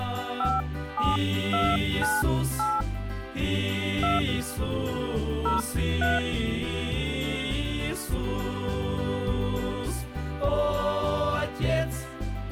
DTMF, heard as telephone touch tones, dialled by hand, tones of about 190 ms. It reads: 57298 2 03